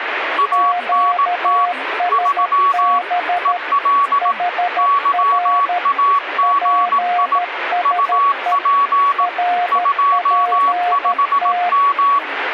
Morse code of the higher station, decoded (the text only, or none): ANT 3 EL YAGI UP 25M